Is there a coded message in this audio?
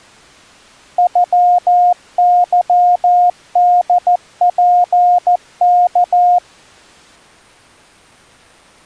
Yes: Morse code (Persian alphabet) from 0.9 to 6.4 s, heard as a keyed tone, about 14 wpm, 710 Hz. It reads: غظدپک